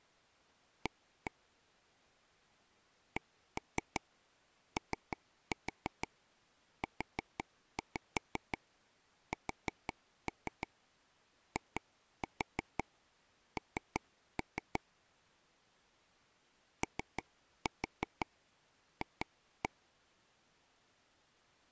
Tap code, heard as taps on a table, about 6 knocks a second. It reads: A COUSIN OF